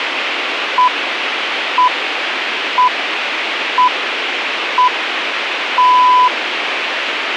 Radio time signal (six pips, as the Greenwich Time Signal), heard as pips, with radio hiss.